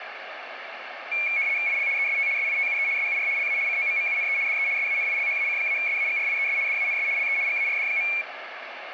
RTTY (75 baud, 170 Hz shift), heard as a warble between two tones, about 2300 Hz centre, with radio static and room echo. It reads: IL EST SITUE SUR LA COMMUNE DE SANILHAC-SAGRIES DANS LE GARD.